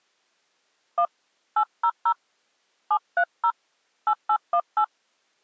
DTMF, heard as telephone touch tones, dialled by hand, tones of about 70 ms. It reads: 1 800 730 8818